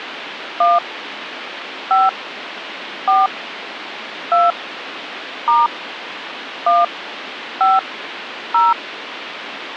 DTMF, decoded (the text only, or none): 1 5 4 2 * 1 5 0